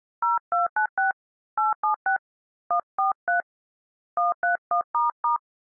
DTMF, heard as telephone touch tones, dialled by hand, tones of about 110 ms. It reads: 0296 876 143 131**